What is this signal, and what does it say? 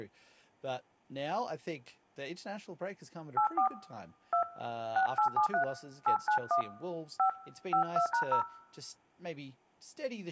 DTMF, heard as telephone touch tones, dialled by hand, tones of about 100 ms, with speech in English. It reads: 84 2 6873 891 5 52#0